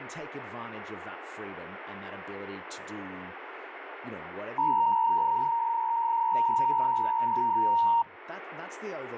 PSK63 (62.5 baud), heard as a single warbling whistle, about 930 Hz, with radio static and speech in English.